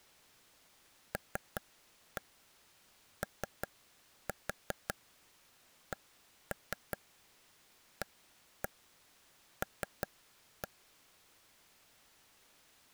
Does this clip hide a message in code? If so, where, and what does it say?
Yes: tap code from 1.1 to 10.7 s, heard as taps on a table, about 5 knocks a second. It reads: LOCAL